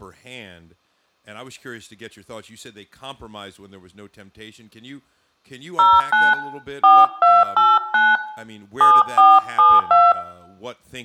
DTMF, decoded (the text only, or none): 09 4289 7472